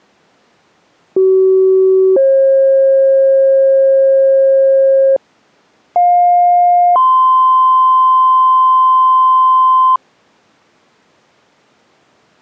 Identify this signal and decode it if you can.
Two-tone page, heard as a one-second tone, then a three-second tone, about 380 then 540 Hz, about 710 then 1040 Hz.